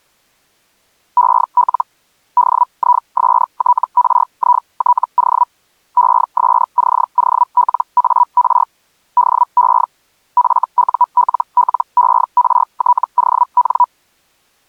Hellschreiber (Feld-Hell, 122.5 baud), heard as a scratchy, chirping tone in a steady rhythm, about 980 Hz. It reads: EL DISTRITO ESCOLAR DE FULLERTON